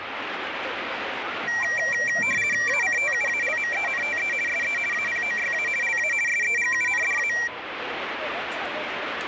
RTTY (50 baud, 450 Hz shift), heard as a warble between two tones, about 2100 Hz centre, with radio static and the noise of a residential street. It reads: ACTUALMENTE SE APOYA LA SEGUNDA